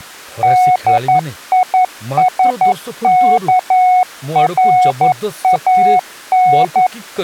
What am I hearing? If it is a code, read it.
Morse code (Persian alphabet), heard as a keyed tone, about 11 wpm, 730 Hz, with speech in Odia. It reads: دیسکران